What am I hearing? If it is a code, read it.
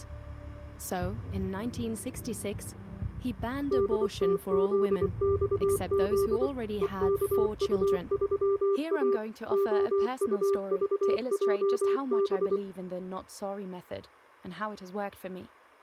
Morse code, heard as a keyed tone, machine-sent, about 24 wpm, 400 Hz. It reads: DTZXZ EKU3A OUVJB